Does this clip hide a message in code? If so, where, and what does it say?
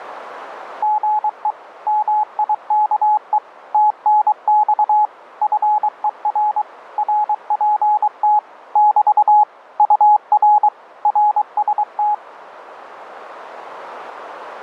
Yes: Morse code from 0.8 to 12.2 s, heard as a keyed tone, machine-sent, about 23 wpm, 840 Hz, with radio static. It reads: GE MIKE TNX FER RPT <BT> UR RST